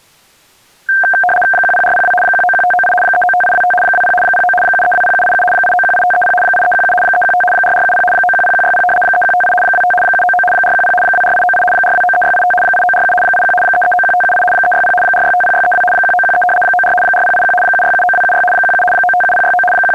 RTTY (75 baud, 850 Hz shift), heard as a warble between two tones, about 1140 Hz centre. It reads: 10402 191598 395825 20 09 7320787 8918530 8317 315 4470 910160 3158 25 799 410 24898 4293685 8947 81 3391578 360 4650632 1913 94 4081 7679276 17 957069 …